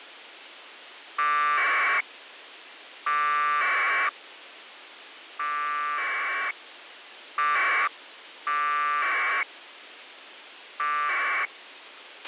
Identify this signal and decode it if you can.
Packet radio (AX.25, as in APRS), 1200 baud, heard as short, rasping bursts, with radio hiss and a squelch burst at the end.